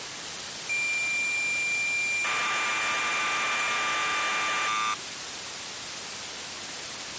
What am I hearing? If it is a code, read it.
Cassette data (Kansas City type), 1200 baud, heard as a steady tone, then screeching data, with tape hiss.